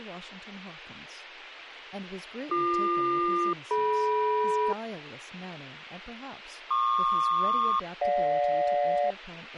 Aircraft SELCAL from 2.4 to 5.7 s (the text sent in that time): BQ-DM